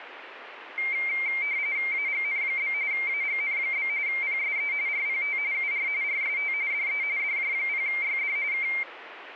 RTTY (45.45 baud, 170 Hz shift), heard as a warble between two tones, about 2200 Hz centre, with radio static. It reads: AGN? AGN? PSE RPT UR RST DE DJ0YD K